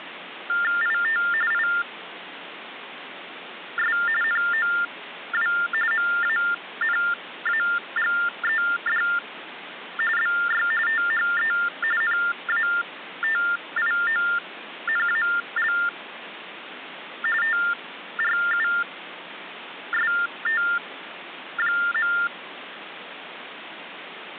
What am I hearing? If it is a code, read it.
TTY/TDD text telephone tones (45.45 baud Baudot), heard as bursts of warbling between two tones, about 400 Hz shift, 1600 Hz centre, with phone line noise. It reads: IT IS NOW MANAGED BY THE NATIONAL TRUST.